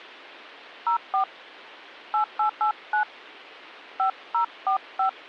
DTMF, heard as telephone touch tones, dialled by hand, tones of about 100 ms. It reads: 04 8889 5045